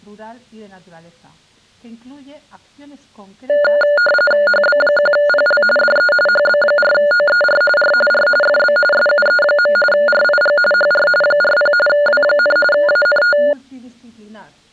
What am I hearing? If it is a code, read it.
RTTY (45.45 baud, 850 Hz shift), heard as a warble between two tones, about 1010 Hz centre. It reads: HB1PL DE HB4OER R R FB SUE. RIG HR 40 W, ANT